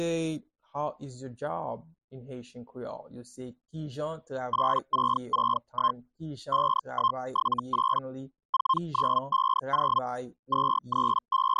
Hellschreiber (Feld-Hell, 122.5 baud), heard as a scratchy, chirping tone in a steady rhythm, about 1060 Hz. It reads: 8661 5178 4950 …